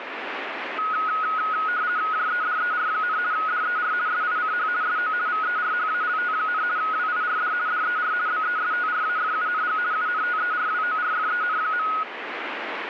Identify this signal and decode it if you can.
RTTY (50 baud, 170 Hz shift), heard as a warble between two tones, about 1360 Hz centre, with radio static. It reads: JEDER, DER SICH SO VERHALT, WIRD DER BESTRAFUNG UNTERWORFEN.